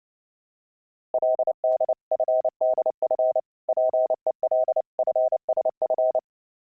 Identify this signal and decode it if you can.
Morse code (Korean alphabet), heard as a keyed tone, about 29 wpm, 640 Hz. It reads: 그는 작년